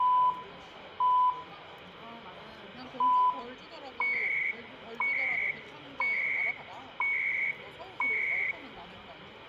Radio time signal (CHU, Canada), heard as beeps and data bursts, one a second, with radio static, room echo and the noise of a crowd indoors.